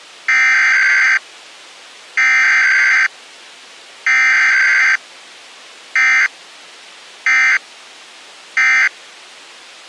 Emergency Alert System (SAME) tones (header bursts, then end-of-message bursts), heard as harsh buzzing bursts, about 520.83 baud.